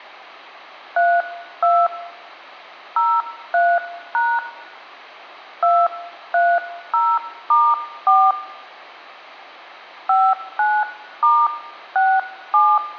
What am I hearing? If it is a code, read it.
DTMF, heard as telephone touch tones, dialled by hand, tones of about 240 ms, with hum. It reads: 32 03# 230*4 59*67